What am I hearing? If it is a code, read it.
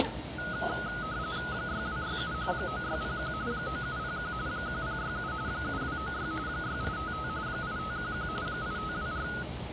RTTY (45.45 baud, 170 Hz shift), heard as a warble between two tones, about 1360 Hz centre, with the noise of a cafe. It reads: 6267 9601 9701 1067 7296 6855 8511 8524